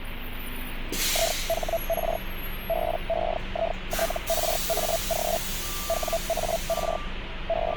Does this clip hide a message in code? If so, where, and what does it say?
Yes: Hellschreiber (Feld-Hell, 122.5 baud) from 1.1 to 7.8 s, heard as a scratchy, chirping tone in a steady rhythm, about 660 Hz, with radio static and street noise. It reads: IHR BEITRAG WAR …